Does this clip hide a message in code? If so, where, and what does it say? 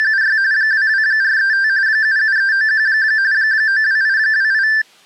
Yes: RTTY (45.45 baud, 170 Hz shift) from 0.0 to 4.8 s, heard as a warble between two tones, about 1650 Hz centre. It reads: … 22435 77391 92828